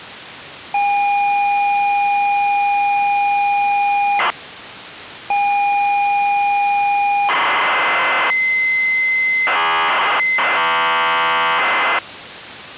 ZX Spectrum tape loading, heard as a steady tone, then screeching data.